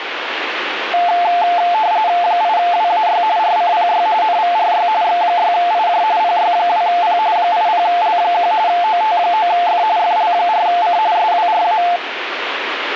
RTTY (45.45 baud, 170 Hz shift), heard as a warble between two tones, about 790 Hz centre, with radio static. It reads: 8WAY RCPY NVRY X6IJ PY2P 80L1 OT9F FL4C SWRA